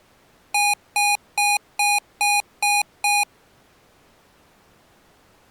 Beep code, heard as beeps from a small speaker, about 820 Hz. 7 short. In AMI BIOS tables: virtual mode exception error; in Dell tables: processor failure.